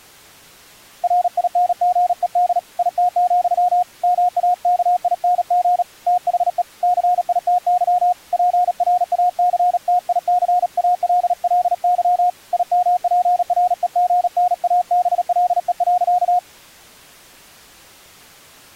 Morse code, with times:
1.0-2.6 RINGED
2.8-3.8 IT,
4.0-5.8 MAKING
6.1-6.6 THE
6.8-8.1 CITY
8.3-12.3 PRACTICALLY
12.5-16.4 IMPREGNABLE.

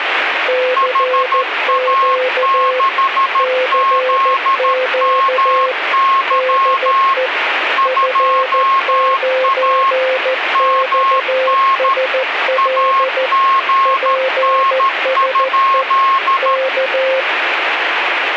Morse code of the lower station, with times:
0.5-2.8 CQ
3.4-5.7 CQ
6.3-7.3 DE
7.9-13.3 F9XSL
13.9-15.8 PSE
16.4-17.2 K

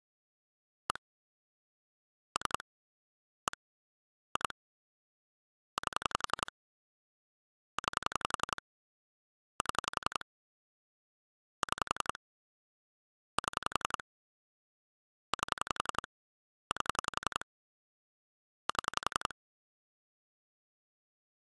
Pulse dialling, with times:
0.9-1.0 1
2.4-2.6 3
3.5-3.6 1
4.4-4.5 2
5.8-6.5 8
7.8-8.6 9
9.6-10.2 7
11.6-12.2 6
13.4-14.0 7
15.3-16.1 8
16.7-17.5 8
18.7-19.3 7

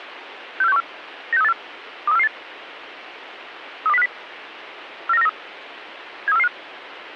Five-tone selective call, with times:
0.6-0.8 64614
1.3-1.5 96384
2.1-2.3 23448
3.9-4.1 32050
5.1-5.3 49493
6.3-6.5 73445

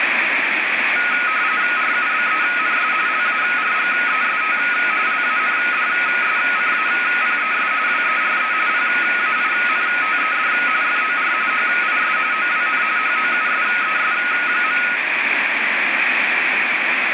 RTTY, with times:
1.8-2.9 RUBENS
3.1-4.6 LARGEST
5.1-7.7 LANDSCAPES
7.9-8.5 WERE
8.7-10.5 PAINTED
10.8-11.3 FOR
11.5-12.2 HIS
12.3-12.8 OWN
13.0-14.8 HOUSES.

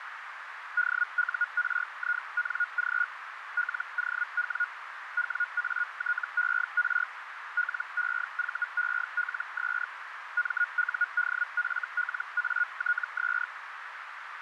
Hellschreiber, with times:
0.8-3.0 DURING
3.6-4.6 LOW
5.2-7.0 WATER
7.6-9.8 LEVELS
10.4-13.4 MUDFLATS

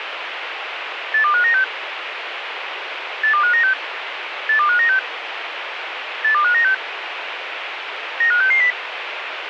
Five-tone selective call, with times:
1.1-1.6 82596
3.2-3.7 82596
4.5-5.0 82596
6.2-6.7 82596
8.2-8.7 95660

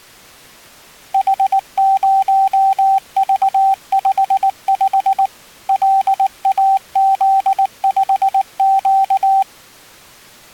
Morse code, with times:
1.1-5.3 H0V55
5.7-9.4 LAZ5Q

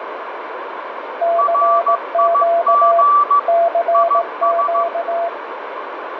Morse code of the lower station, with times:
1.2-3.0 CQ
3.5-5.3 CQ

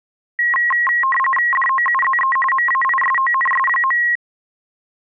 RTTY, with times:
1.5-2.4 DOUZE
2.5-4.0 MAISONS.

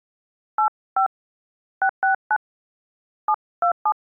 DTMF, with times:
0.6-1.1 85
1.8-2.4 669
3.3-3.9 727

